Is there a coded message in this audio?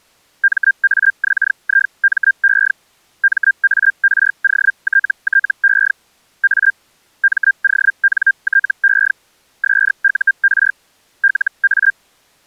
Yes: Hellschreiber (Feld-Hell, 122.5 baud) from 0.4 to 11.9 s, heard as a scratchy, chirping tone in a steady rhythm, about 1600 Hz. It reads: MAXIME MAROTTE A MONTE SUR LA